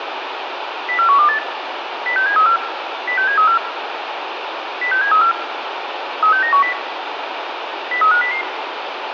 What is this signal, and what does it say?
Five-tone selective call (CCIR), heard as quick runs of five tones, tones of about 100 ms, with radio hiss. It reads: 04128 06734 06734 06734 36910 03500